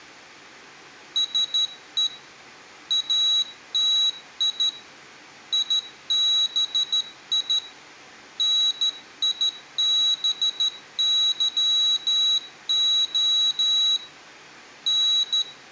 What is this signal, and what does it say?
Morse code, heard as a high beeper, hand-sent with a straight key, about 13 wpm, 3900 Hz. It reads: SE ATI IBI NIBYO …